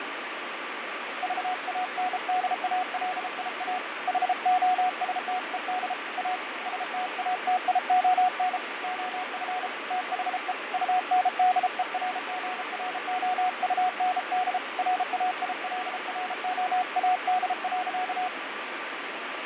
Morse code, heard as a keyed tone, hand-sent with a bug key, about 33 wpm, 730 Hz, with radio static and fading. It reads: VANDALIA HOSTED A STATION OF THE UNDERGROUND RAILROAD.